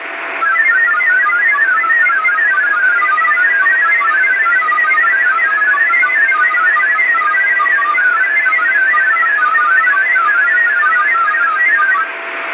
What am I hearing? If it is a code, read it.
Multi-tone FSK (Olivia or MFSK type), about 1000 Hz wide, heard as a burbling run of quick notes, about 31.25 baud, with radio static, a steady whistle near 670 Hz and room echo.